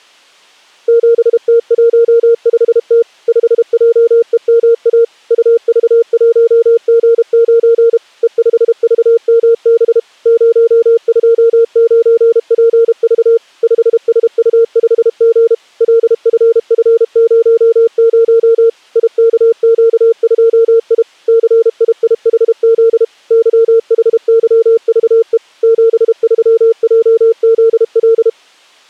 Morse code, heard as a keyed tone, machine-sent, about 32 wpm, 460 Hz. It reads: 7T15T 5JEMA UV1G9 E5VMB 029PV 5SU5G LFF00 IKQ2I CIIHZ YHYVE 73JZL